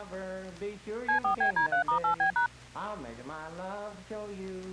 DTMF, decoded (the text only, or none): C4BD3*8B#